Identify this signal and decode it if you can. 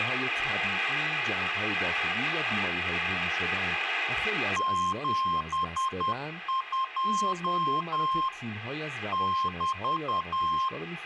Morse code, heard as a keyed tone, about 10 wpm, 1060 Hz, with room echo and speech in Persian. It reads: 72 <BT>